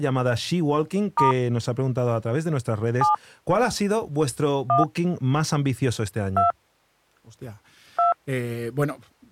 DTMF, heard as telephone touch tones, dialled by hand, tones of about 140 ms, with speech in Spanish. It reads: * 7 1 2 2